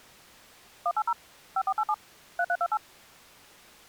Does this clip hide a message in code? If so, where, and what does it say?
Yes: DTMF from 0.9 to 2.8 s, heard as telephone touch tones, dialled by machine, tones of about 60 ms. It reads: 180 5487 3328